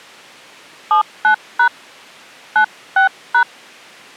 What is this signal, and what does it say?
DTMF, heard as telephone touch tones, dialled by hand, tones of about 100 ms. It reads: 79# 96#